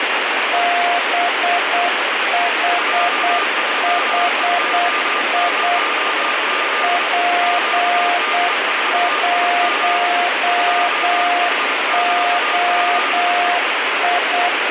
Morse code, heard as two keyed tones, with heavy radio static. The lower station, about 8 wpm, 700 Hz: BHHI P1OI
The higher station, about 26 wpm, 1210 Hz: J320Z QD4IG 2HQZE